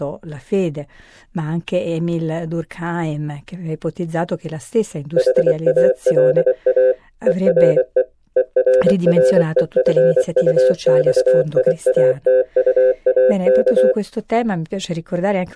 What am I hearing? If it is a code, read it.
Morse code, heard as a keyed tone, machine-sent, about 24 wpm, 510 Hz, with speech in Italian. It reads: HALA ERE ERREFUXIATUAK